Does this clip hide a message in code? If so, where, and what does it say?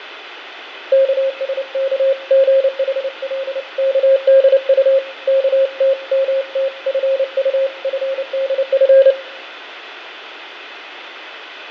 Yes: Morse code (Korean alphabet) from 0.9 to 9.2 s, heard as a keyed tone, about 29 wpm, 540 Hz, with radio static, fading and room echo. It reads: 영숙의 어머니는